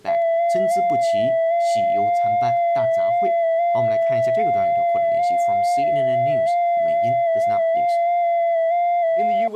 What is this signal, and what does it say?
FT8 (one signal), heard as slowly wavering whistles, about 6.25 baud, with speech in Chinese.